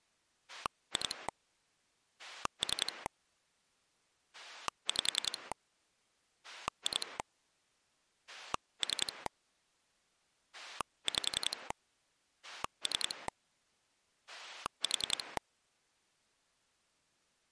Pulse dialling, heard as a rotary dial, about 10 pulses a second. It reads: 2 3 5 2 3 5 3 4